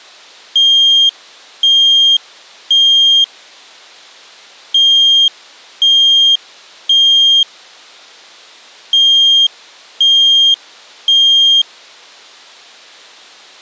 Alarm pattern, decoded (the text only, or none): temporal three